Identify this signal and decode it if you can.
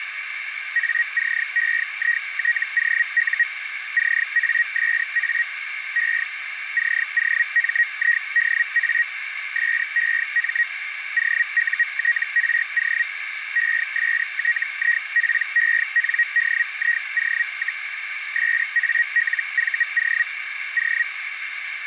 Hellschreiber (Feld-Hell, 122.5 baud), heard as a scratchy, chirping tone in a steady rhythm, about 1900 Hz, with radio static and a narrow filter. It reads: ACEITOU CASA E COMIDA SEM OUTRO ESTIPENDIO, SALVO O